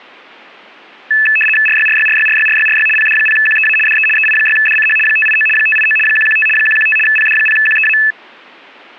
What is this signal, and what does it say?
RTTY (75 baud, 850 Hz shift), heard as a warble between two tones, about 2150 Hz centre. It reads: RYRYRYRYRYRY PD0QEA DE EI6DCH 589 589 115 115 PD0QEA